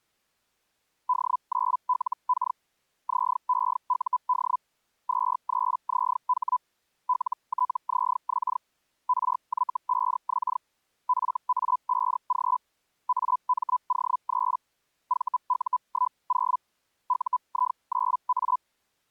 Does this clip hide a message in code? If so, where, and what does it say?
Yes: Hellschreiber (Feld-Hell, 122.5 baud) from 1.1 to 18.6 s, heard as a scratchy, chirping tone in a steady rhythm, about 1000 Hz. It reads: D9LK ZEUD 23ZH LTZX RY5X FA5G AMO3 VU10 UI9A